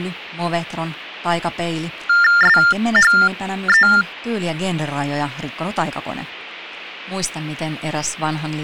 TTY/TDD text telephone tones (45.45 baud Baudot), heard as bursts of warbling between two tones, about 400 Hz shift, 1600 Hz centre, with speech in Finnish. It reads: SHE